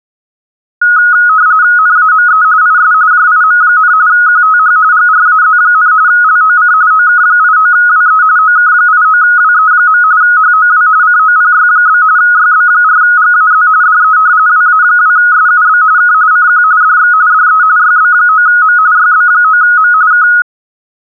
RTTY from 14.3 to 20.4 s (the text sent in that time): WA2SUB K CQ DX DE YB9M YB9M K